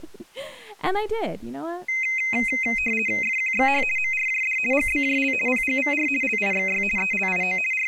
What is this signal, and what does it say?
RTTY (50 baud, 450 Hz shift), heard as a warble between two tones, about 2300 Hz centre, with speech in English. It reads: FQXH MRJD GBJL PGVR LIXY ELIO …